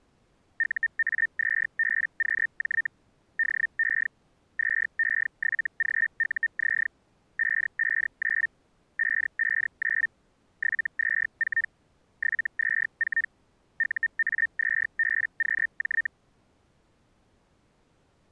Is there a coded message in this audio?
Yes: Hellschreiber (Feld-Hell, 122.5 baud) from 0.6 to 16.1 s, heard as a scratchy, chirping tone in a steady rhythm, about 1800 Hz. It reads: UA2BQJ DE 2E7GUZ 559 559 724 724 UA2BQJ